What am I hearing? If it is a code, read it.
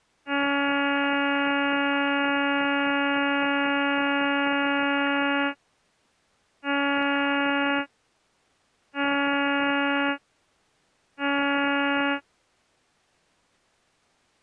Ship horn signal, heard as a ship's horn, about 280 Hz. 1 long, 3 short. At sea: a vessel under tow in fog.